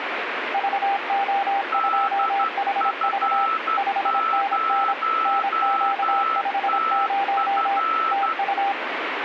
Morse code, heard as two keyed tones, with radio static. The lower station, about 26 wpm, 790 Hz: VO2HV 5NN NQ50 TU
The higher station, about 12 wpm, 1320 Hz: DF0TF